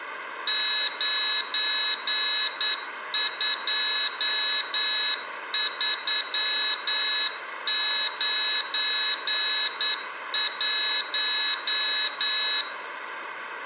Morse code, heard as a high beeper, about 9 wpm, 3850 Hz, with room echo. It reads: 92391